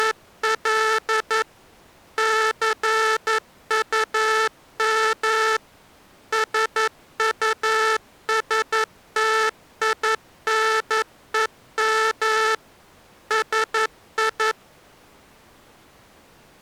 Morse code, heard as a buzzer, machine-sent, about 11 wpm. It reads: … CUM SUSTINEM SI